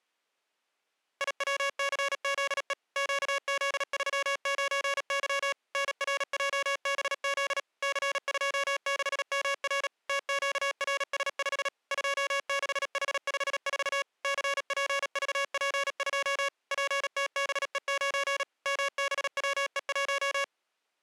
Morse code, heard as electronic beeps, machine-sent, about 37 wpm, 560 Hz. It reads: IWCZE QZ39Y NRJBZ C26MR TQRS5 26H54 CPVP2 PTBE9 MBWE1